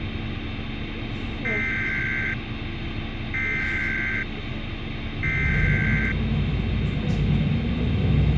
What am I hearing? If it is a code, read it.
Emergency Alert System (SAME) tones (header bursts), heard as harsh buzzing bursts, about 520.83 baud, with radio hiss, a squelch burst at the end and the noise inside a bus.